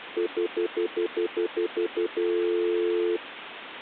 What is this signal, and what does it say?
Telephone call progress tone (North American plan), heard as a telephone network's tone, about 350, 440 Hz, 0.1 s on and 0.1 s off, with phone line noise. Stutter dial tone.